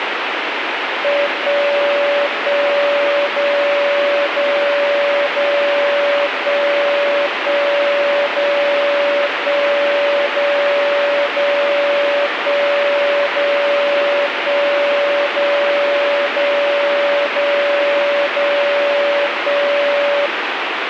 Radio time signal (DCF77), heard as a tone whose level steps once a second, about 570 Hz, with radio static. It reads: 1 1 0 0 0 1 1 0 1 0 0 1 0 1 0 0 0 0 1